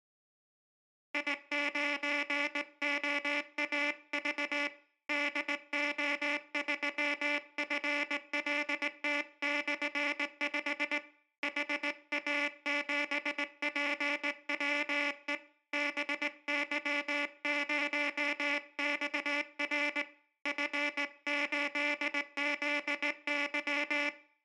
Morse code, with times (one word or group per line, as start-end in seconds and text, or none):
1.1-4.7 I9OAV
5.1-11.0 DO3FLT/5
11.4-15.3 HA7PWE
15.7-20.0 BY0XR
20.5-24.1 F8ZY